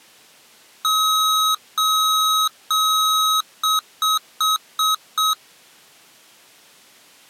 Beep code, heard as beeps from a small speaker, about 1270 Hz. 3 long, 5 short.